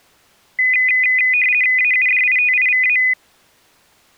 RTTY (50 baud, 450 Hz shift), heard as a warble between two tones, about 2250 Hz centre. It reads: AUDITIVA